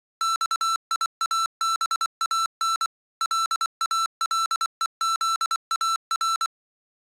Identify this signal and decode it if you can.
Morse code (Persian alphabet), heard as electronic beeps, machine-sent, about 24 wpm, 1340 Hz. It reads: خیابان لالهزار